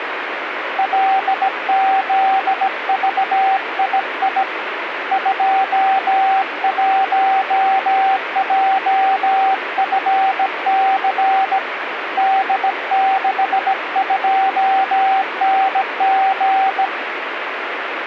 Morse code, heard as a keyed tone, hand-sent with a bug key, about 17 wpm, 770 Hz, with radio static. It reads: LZVII 21JFC D62NG